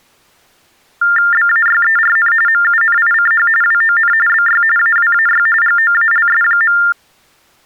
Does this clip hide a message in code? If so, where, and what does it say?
Yes: TTY/TDD text telephone tones (45.45 baud Baudot) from 1.0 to 6.9 s, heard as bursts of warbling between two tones, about 400 Hz shift, 1600 Hz centre. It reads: BAYERN MUNICH WON BY AWAY GOALS.